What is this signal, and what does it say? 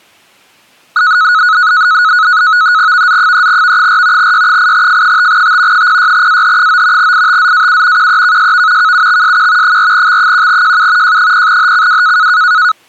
NAVTEX (SITOR-B), 100 baud, 170 Hz shift, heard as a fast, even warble, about 1370 Hz centre. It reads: VZ3V4 Y8F5T 06AH9 ITZAU QEKSV KUXSQ 4X1JU J0HCW